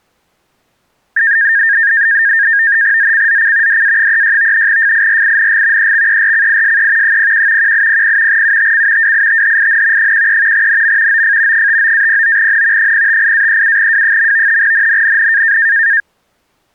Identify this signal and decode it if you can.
NAVTEX (SITOR-B), 100 baud, 170 Hz shift, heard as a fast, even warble, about 1700 Hz centre. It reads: ZCZC DA36 FIRING EXERCISE 01 1800 UTC WITHIN 13 NM OF 59-09N 058-37W. NNNN